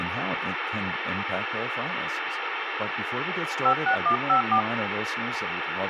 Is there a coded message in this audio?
Yes: DTMF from 3.6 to 4.6 s, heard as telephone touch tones, dialled by hand, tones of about 90 ms, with radio hiss and speech in English. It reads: 56154